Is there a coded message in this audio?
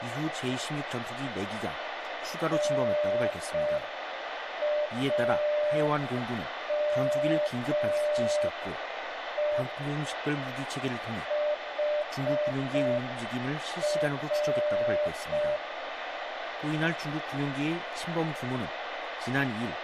Yes: Morse code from 2.5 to 15.6 s, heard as a keyed tone, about 5 wpm, 600 Hz, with radio static and room echo. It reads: NAME HR